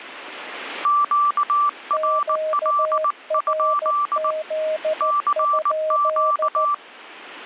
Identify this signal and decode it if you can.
Morse code, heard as two keyed tones. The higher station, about 19 wpm, 1170 Hz: QRL? CQ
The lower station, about 14 wpm, 620 Hz: QRZ?